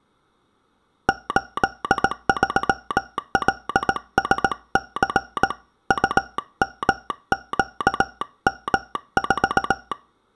Morse code, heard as a telegraph sounder, hand-sent with a paddle, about 18 wpm, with room echo. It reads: 83LSC UMQM4